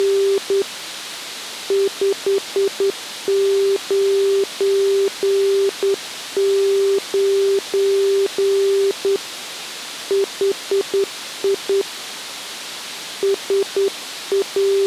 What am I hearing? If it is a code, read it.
Morse code, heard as a keyed tone, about 9 wpm, 390 Hz. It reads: … 599 HI …